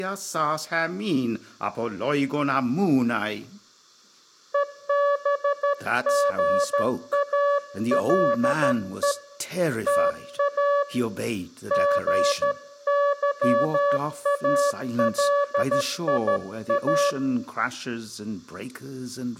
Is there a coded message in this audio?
Yes: Morse code (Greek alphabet) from 4.5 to 17.2 s, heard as a keyed tone, hand-sent with a straight key, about 13 wpm, 570 Hz, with room echo and speech in English. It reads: ΕΒΓΑΛΕ ΤΑ ΓΥΑΛΙΑ